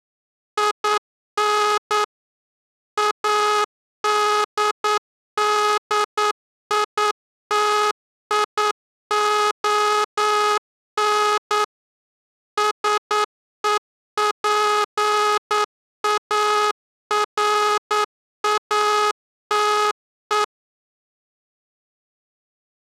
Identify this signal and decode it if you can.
Morse code, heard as a buzzer, machine-sent, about 9 wpm. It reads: IN ADDITION SEPARATE